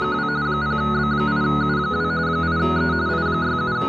RTTY (45.45 baud, 170 Hz shift), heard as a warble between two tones, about 1360 Hz centre. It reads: … 0B8U2 8E …